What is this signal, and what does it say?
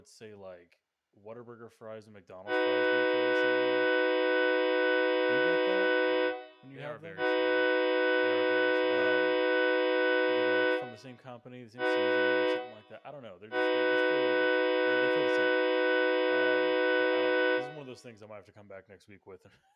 Train horn signal, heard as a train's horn, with room echo and speech in English. 2 long, 1 short, 1 long. On North American railways: approaching a public crossing.